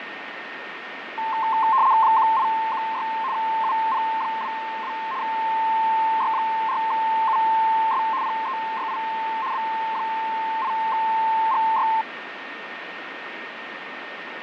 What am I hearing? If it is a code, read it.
RTTY (75 baud, 170 Hz shift), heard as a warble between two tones, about 970 Hz centre, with radio static, fading and a steady whistle near 1840 Hz. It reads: 1816 UP22 Y4US PEYI B8GY